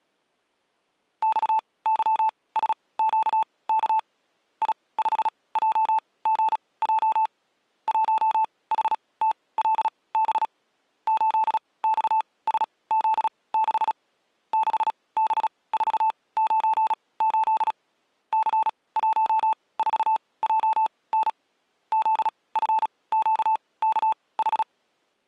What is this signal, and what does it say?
Morse code, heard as a keyed tone, machine-sent, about 36 wpm, spaced as for 22 wpm, 880 Hz. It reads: XYSQK I5JGJ 1HTLB 8XSZ6 6B498 C14JN ZFQKH